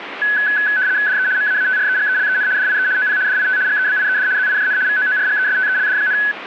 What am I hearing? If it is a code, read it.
RTTY (75 baud, 170 Hz shift), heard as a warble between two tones, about 1600 Hz centre, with radio static. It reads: DE MAATREGELEN DIE OP DIT GEBIED ZIJN VOORGESTELD,